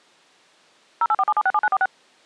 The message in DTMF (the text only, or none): 0847767946